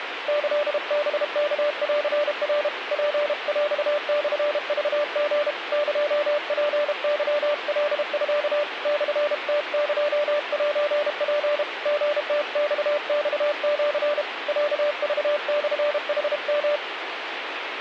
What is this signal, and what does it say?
Morse code (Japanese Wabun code), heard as a keyed tone, hand-sent with a paddle, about 32 wpm, 590 Hz, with radio static. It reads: キハワンナ ツヰモクリ エツケカミ モムエセツ リムママシ ロクモヌヨ